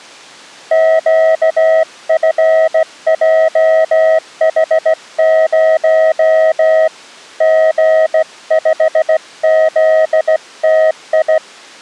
Morse code, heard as a keyed tone, hand-sent with a straight key, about 16 wpm, 640 Hz. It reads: QFJH0 G5ZTI